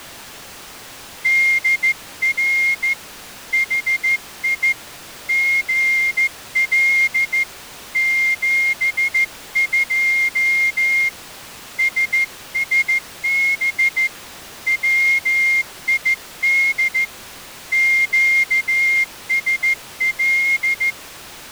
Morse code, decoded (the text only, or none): DR HI GL 72 SSB WID QSL